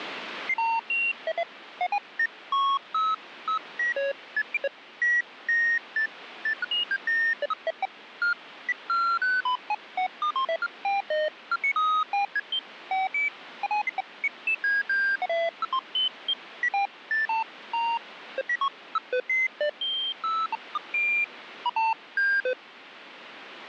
Electronic bleeps of random pitch and length, with radio static. There is no code.